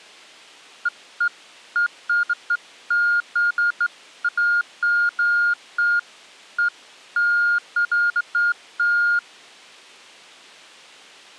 Beeps of irregular length. There is no code.